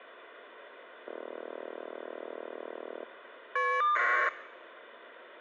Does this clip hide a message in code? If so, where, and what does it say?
Yes: caller ID data burst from 1.1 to 4.3 s, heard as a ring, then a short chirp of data, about 1200 baud.